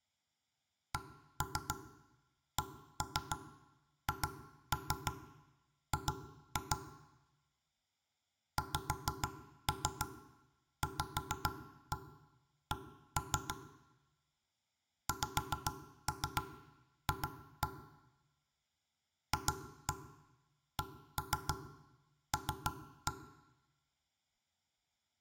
Tap code, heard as knocks on wood, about 6 knocks a second, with room echo. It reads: CCHG XVC XF FCL